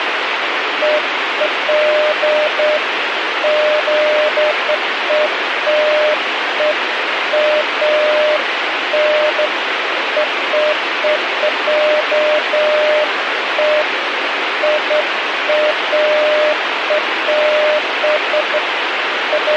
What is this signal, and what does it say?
Beeps of irregular length, with radio hiss. There is no code.